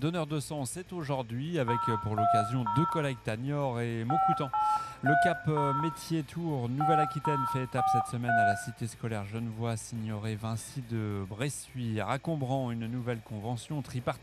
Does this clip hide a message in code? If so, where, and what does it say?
Yes: DTMF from 1.7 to 8.5 s, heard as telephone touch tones, dialled by hand, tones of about 230 ms, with room echo. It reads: 020 5830 5043